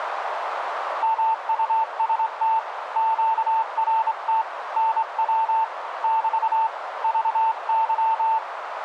Morse code, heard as a keyed tone, hand-sent with a straight key, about 25 wpm, 890 Hz, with radio static and a narrow filter. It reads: MUST QRT NW <BT> VY